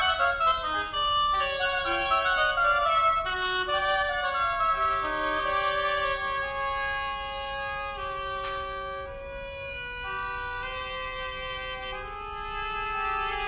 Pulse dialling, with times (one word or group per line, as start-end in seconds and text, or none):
none